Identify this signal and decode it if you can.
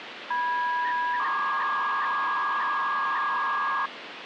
300-baud modem data (V.21 tones), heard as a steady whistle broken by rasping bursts, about 300 baud, 200 Hz shift, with phone line noise.